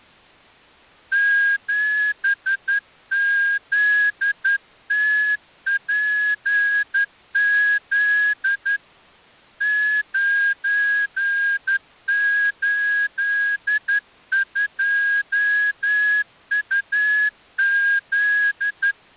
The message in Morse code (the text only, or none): 7ZTPZ 982UZ